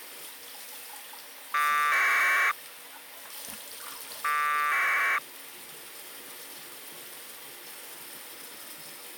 Packet radio (AX.25, as in APRS), 1200 baud, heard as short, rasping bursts, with the noise of a restroom.